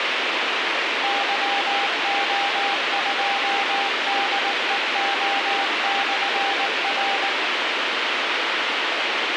Morse code, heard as a keyed tone, machine-sent, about 19 wpm, 800 Hz, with radio hiss. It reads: YO2DEO/R